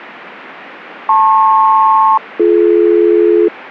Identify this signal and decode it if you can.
Aircraft SELCAL, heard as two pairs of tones. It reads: LP-BD